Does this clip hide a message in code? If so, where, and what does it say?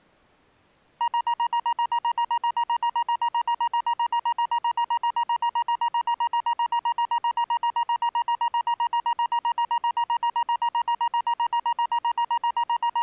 No, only evenly repeated beeps.